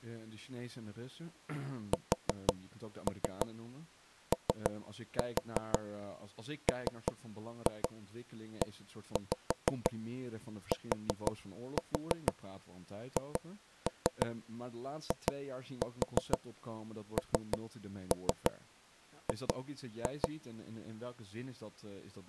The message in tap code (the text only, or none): SOMETHING